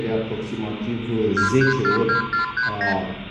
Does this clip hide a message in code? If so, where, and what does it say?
Yes: multi-frequency trunk signalling (R2, with the far end's replies) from 1.4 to 3.0 s, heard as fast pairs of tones, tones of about 120 ms, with room echo. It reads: 2342439